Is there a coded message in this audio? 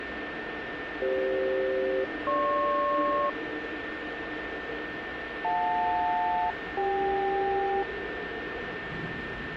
Yes: aircraft SELCAL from 1.0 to 7.8 s, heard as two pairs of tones, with radio static, a steady whistle near 1800 Hz and the noise inside a subway train. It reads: CF-GP JL-CK